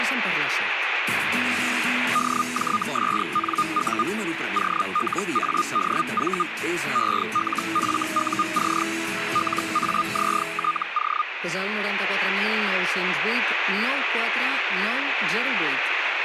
Hellschreiber (Feld-Hell, 122.5 baud), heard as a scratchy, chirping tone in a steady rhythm, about 1220 Hz, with radio static. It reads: DJSNU OLADV ELFUC LAZTO